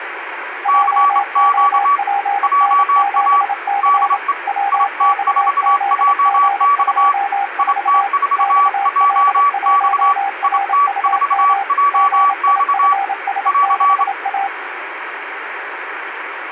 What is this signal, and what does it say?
Morse code, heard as two keyed tones, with radio static. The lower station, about 27 wpm, 800 Hz: JOPN7C WXZG24 XL1RUM GIFS6A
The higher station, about 27 wpm, 1150 Hz: CQ JA DE IT4JX IT4JX IT4JX <AR>